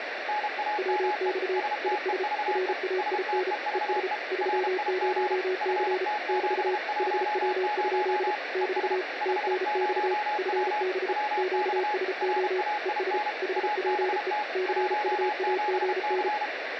Morse code, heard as two keyed tones, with radio static. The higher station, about 32 wpm, 840 Hz: NAME STEVE STEVE RIG FT710 ES 50W WX RAIN ABT 17C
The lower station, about 34 wpm, 370 Hz: WX IS RAIN ES 30C <BT> HW? <BT> TNX FB QSO ES HPE CUAGN